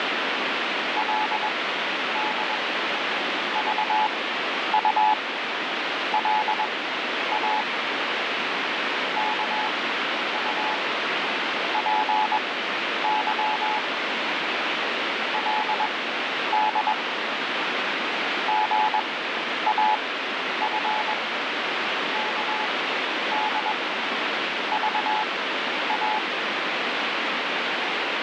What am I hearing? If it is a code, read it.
Morse code (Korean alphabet), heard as a keyed tone, machine-sent, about 21 wpm, spaced as for 10 wpm, 860 Hz, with heavy radio static. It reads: 그리고 이제 그 손으로